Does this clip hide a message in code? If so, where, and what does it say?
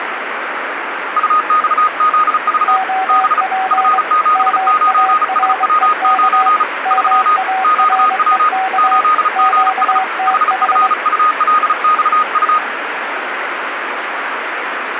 Yes: Morse code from 1.1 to 12.6 s, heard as two keyed tones, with radio static. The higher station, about 35 wpm, 1240 Hz: UXZV B F79SW9 3 QW 8GS HFULXU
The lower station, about 23 wpm, 760 Hz: OP MAREK MAREK QTH